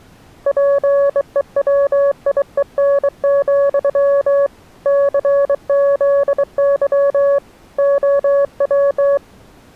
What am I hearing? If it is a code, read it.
Morse code, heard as a keyed tone, hand-sent with a bug key, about 23 wpm, 560 Hz. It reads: PEWIEN, CZY OW